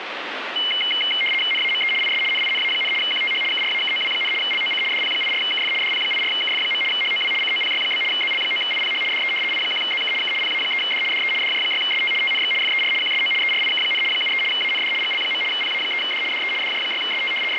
RTTY (75 baud, 850 Hz shift), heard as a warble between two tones, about 2550 Hz centre, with radio static. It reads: NAME IS NINA, QTH KRAKOW, LOC DP84KF DP84KF. HOW COPY? ZL9IPH DE I1ZK K PA3D DE DJ6ST TNX FER QSO ERIK, 73 AND GL. PA3D DE DJ6ST …